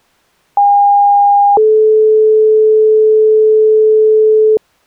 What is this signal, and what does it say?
Two-tone page, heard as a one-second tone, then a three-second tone, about 810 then 430 Hz.